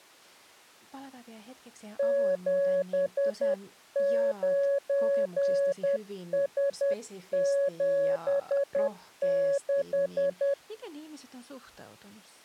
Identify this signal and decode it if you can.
Morse code, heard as a keyed tone, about 10 wpm, 560 Hz, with speech in Finnish. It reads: 79S76